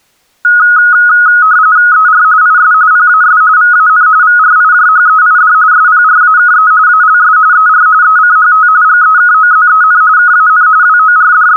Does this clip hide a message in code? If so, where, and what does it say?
Yes: RTTY (45.45 baud, 170 Hz shift) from 0.4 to 11.6 s, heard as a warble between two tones, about 1360 Hz centre. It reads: ER IS PAS VAN VRIJHEID SPRAKE ALS ER ECHT GEKOZEN KAN …